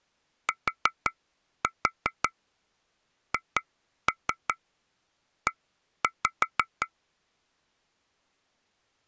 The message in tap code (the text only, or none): THE